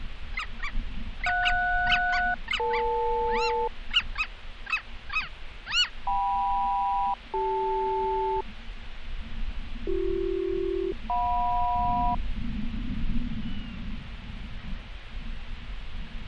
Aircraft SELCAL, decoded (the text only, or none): JS-EL KM-CL BC-JM